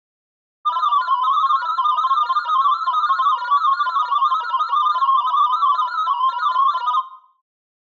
Multi-tone FSK (Olivia or MFSK type), about 500 Hz wide, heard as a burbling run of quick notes, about 31.25 baud, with room echo.